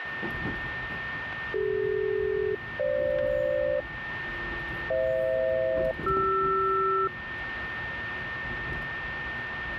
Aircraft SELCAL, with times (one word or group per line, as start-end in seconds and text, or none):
1.5-3.8 CD-FG
4.9-7.1 FH-CR